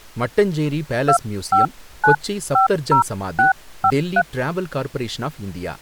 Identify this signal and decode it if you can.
DTMF, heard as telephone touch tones, dialled by hand, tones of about 100 ms, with speech in Tamil. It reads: 25950653